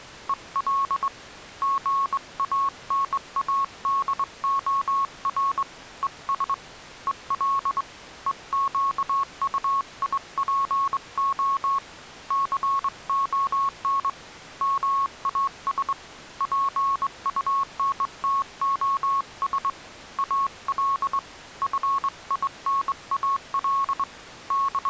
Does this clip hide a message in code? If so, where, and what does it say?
Yes: Morse code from 0.2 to 24.9 s, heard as a keyed tone, hand-sent with a straight key, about 22 wpm, 1100 Hz. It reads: EL GANADOR ES EL EQUIPO CON MAS PUNTOS AL FINAL …